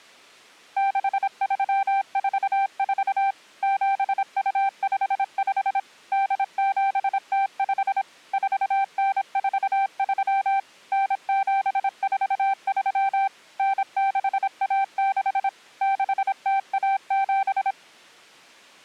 Morse code (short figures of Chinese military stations), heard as a keyed tone, machine-sent, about 26 wpm, 780 Hz. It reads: 6344 7255 8705 4943 9743 9616 6017